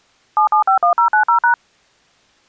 DTMF, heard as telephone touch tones, dialled by machine, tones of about 100 ms. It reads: 7751090#